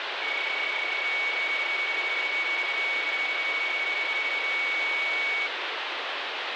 PSK31 (31.25 baud), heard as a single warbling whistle, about 2250 Hz, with radio static.